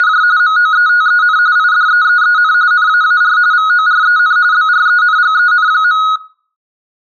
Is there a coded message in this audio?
Yes: RTTY (45.45 baud, 170 Hz shift) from 0.0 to 6.2 s, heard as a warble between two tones, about 1360 Hz centre. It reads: … MOETEN IDEEEN NAAR VOREN BRENGEN.